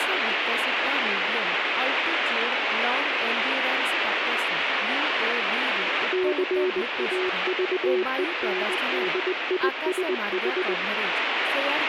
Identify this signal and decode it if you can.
Morse code, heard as a keyed tone, hand-sent with a straight key, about 20 wpm, 370 Hz, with heavy radio static and speech in Odia. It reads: CAVENDISH